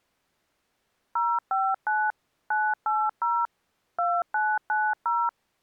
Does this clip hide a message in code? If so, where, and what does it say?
Yes: DTMF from 1.2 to 5.3 s, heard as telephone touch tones, dialled by machine, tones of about 240 ms. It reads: 059 980 2990